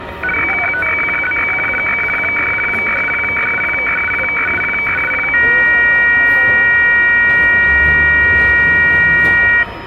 Weather fax (radiofax), 120 lines a minute, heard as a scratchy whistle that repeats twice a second, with radio static, a steady whistle near 940 Hz and the noise of a crowd indoors.